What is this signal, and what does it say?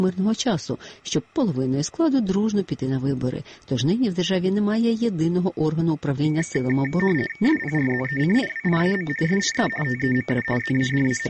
RTTY (50 baud, 450 Hz shift), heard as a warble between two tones, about 2050 Hz centre. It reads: SPRZECIWIAM SIE TEMU …